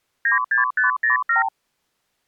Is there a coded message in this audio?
Yes: multi-frequency trunk signalling (R2, with the far end's replies) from 0.3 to 1.5 s, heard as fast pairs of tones, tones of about 130 ms. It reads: 96507